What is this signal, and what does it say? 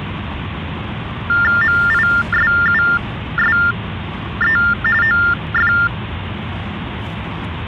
TTY/TDD text telephone tones (45.45 baud Baudot), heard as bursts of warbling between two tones, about 400 Hz shift, 1600 Hz centre, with phone line noise and the noise inside a car. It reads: MISUSE OF